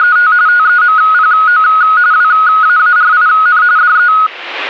RTTY (45.45 baud, 170 Hz shift), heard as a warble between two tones, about 1360 Hz centre. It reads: … TEMPO WAARIN DE